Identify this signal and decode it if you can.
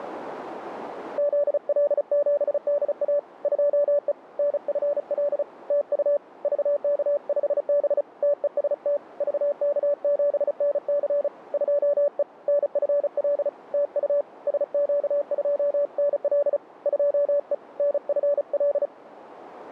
Morse code, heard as a keyed tone, hand-sent with a paddle, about 35 wpm, 580 Hz, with radio static. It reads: ZL7DA 2E NFL TU VK5B TEST VK7NC 2E NFL TU SQ2NL 2E NFL